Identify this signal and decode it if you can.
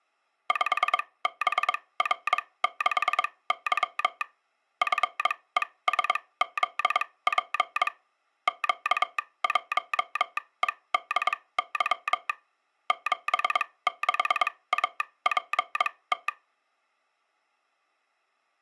Morse code, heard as a telegraph sounder, machine-sent, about 22 wpm, spaced as for 18 wpm. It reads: 5BR6Y FESZP Q1EDY 76APT